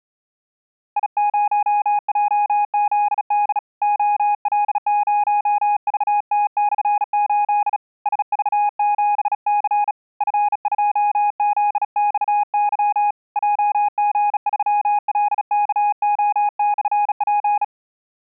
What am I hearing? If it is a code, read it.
Morse code, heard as a keyed tone, hand-sent with a bug key, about 36 wpm, 830 Hz. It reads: I0JZD OL0VT/8 SV7C F2ZXY JG3LKO/P